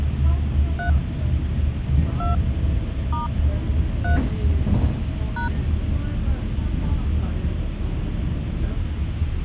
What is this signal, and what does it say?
DTMF, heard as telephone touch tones, dialled by hand, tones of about 130 ms, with the noise inside a bus. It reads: 3 2 * 3 #